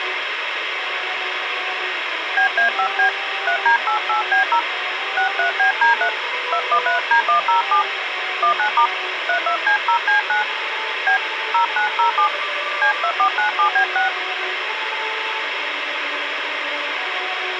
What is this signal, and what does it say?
DTMF, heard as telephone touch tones, dialled by hand, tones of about 100 ms, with radio hiss. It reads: BA5B 3D88B0 63BD3 213D107 19* 32C0C9 B 0907 C2497B6